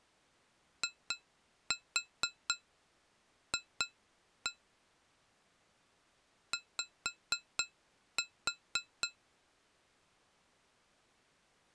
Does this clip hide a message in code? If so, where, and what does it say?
Yes: tap code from 0.8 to 9.2 s, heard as taps on glass, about 4 knocks a second. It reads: IF Y